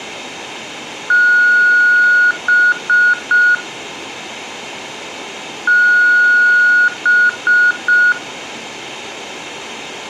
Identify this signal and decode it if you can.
Beep code, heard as beeps, played twice, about 1450 Hz, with room echo. 1 long, 3 short. In Award and IBM BIOS tables: video adapter failure; in AMI BIOS tables: memory failure.